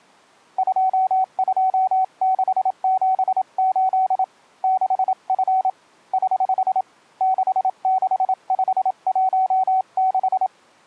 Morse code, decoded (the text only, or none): 22678 6F <HH> 66516